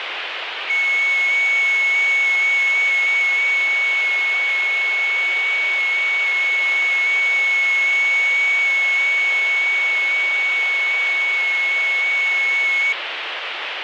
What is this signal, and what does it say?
FT8 (one signal), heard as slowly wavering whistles, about 6.25 baud, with radio static.